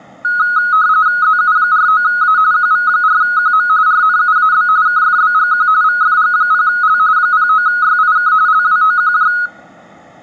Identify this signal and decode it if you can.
RTTY (45.45 baud, 170 Hz shift), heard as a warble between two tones, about 1360 Hz centre, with room echo. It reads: ZU49A QV4QM RNUAB KFBGQ VFG0L 09YIK LWOQJ